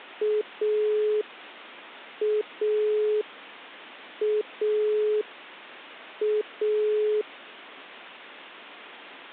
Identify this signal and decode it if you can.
Telephone call progress tone (pulsed, as in Italy), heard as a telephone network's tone, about 420 Hz. Dial tone.